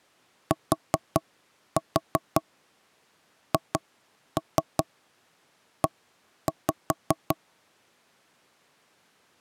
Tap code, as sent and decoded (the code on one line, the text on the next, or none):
4-4 2-3 1-5
THE